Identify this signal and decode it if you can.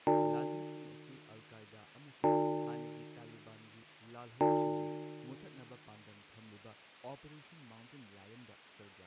Clock strike, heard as a bell, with speech in Manipuri. 3. Three o'clock.